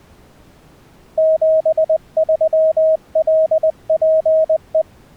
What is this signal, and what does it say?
Morse code, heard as a keyed tone, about 20 wpm, 640 Hz. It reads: 73LPE